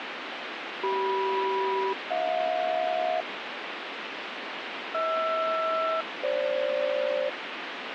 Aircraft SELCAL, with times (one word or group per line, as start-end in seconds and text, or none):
0.8-3.2 CM-HJ
4.9-7.3 HR-FG